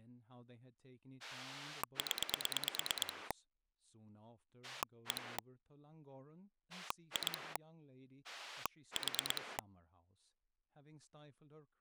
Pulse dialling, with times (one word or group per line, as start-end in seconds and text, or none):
1.2-3.3 0
4.6-5.4 1
6.7-7.6 2
8.2-9.6 4